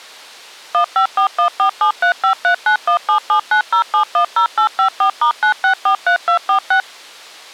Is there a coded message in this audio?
Yes: DTMF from 0.7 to 6.8 s, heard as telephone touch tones, dialled by machine, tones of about 100 ms. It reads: 154147353917790710854*9643246